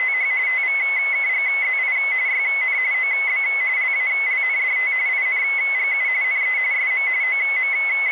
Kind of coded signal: RTTY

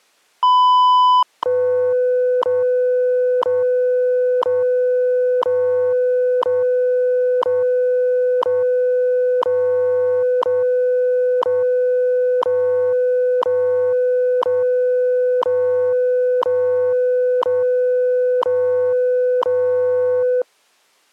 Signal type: radio time signal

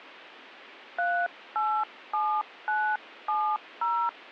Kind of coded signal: DTMF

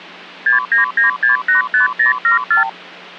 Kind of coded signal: multi-frequency trunk signalling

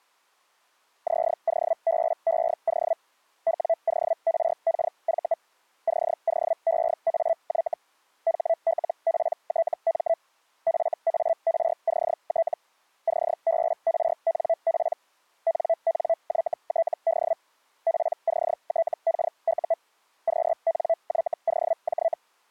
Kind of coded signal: Hellschreiber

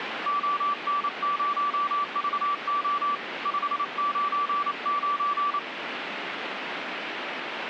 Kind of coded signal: Morse code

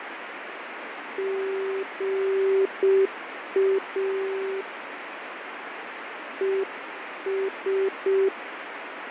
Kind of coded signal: Morse code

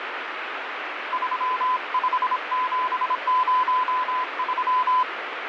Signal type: Morse code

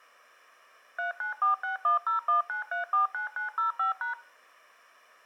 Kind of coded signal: DTMF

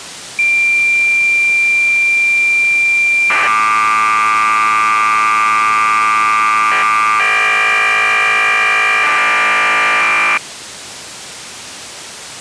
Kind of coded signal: cassette data (Kansas City type)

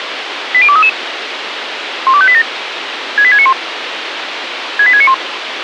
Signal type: five-tone selective call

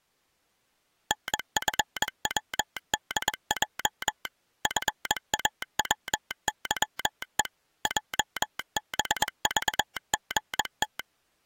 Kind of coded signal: Morse code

